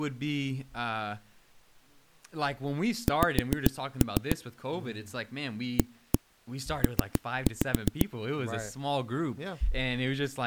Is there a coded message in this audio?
Yes: tap code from 3.1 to 8.1 s, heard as knocks on a wall, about 7 knocks a second, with speech in English. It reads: X AP